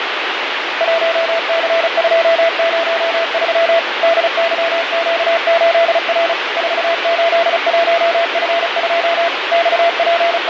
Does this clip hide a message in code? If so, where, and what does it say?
Yes: Morse code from 0.7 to 10.5 s, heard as a keyed tone, machine-sent, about 35 wpm, 670 Hz, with radio static. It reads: 1C203 DYQ8R 481F2 …